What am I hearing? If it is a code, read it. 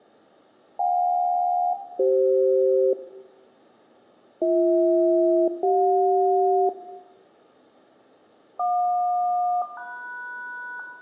Aircraft SELCAL, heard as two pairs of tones, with room echo. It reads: JK-CF BH-CJ JQ-MS